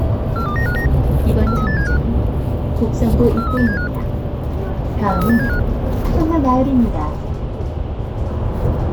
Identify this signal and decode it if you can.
Five-tone selective call (CCIR), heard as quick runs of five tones, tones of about 100 ms, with the noise inside a bus. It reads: 42959 43875 43875 43875